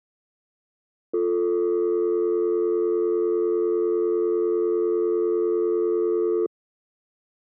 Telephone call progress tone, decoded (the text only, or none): dial tone